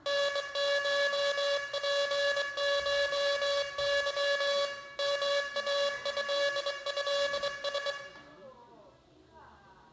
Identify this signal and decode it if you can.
Morse code (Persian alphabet), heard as a buzzer, hand-sent with a straight key, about 23 wpm, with room echo and the noise of a cafe. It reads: نشپشظ ماضضس